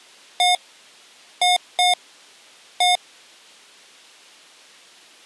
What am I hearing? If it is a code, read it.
Beep code, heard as beeps from a small speaker, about 720 Hz. 1-2-1. In Phoenix BIOS tables: interval timer failure.